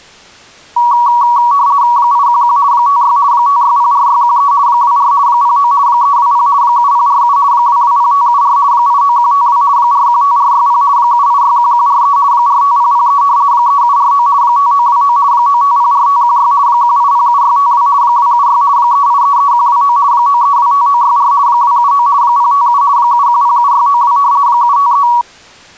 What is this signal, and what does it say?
RTTY (50 baud, 170 Hz shift), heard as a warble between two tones, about 1040 Hz centre. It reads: 811 56 5604613 24 09 320 7047 220574 89152 415460 7861143 45003 3749 5929 9504516 1807652 276 3833129 9325964 279 057 7107692 753